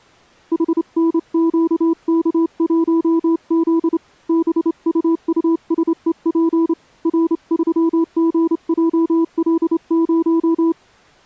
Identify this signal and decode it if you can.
Morse code, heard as a keyed tone, hand-sent with a straight key, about 28 wpm, 330 Hz. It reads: HNQK1Z BUUSEP R3GJL0